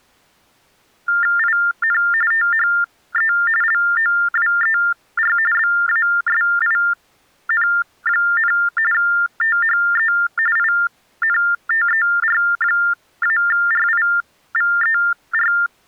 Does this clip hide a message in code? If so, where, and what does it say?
Yes: TTY/TDD text telephone tones (45.45 baud Baudot) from 1.1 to 15.7 s, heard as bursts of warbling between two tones, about 400 Hz shift, 1600 Hz centre. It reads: IN THE LOWER BASIN, THE INTER-RIVER